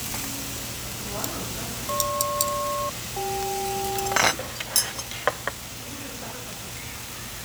Aircraft SELCAL, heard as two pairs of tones, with static crashes and the noise of a restaurant. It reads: GP-CK